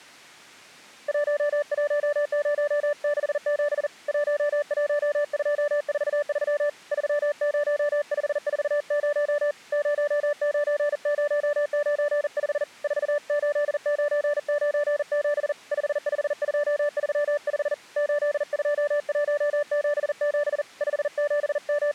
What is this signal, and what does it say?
Morse code, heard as a keyed tone, hand-sent with a paddle, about 40 wpm, 590 Hz. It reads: 11067 11243 30540 09095 48997 55235 82177 …